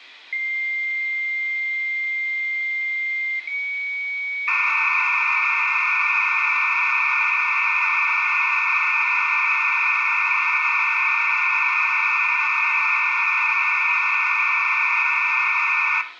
Dial-up modem handshake (low-speed, two carriers), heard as two whistles, then hiss, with room echo.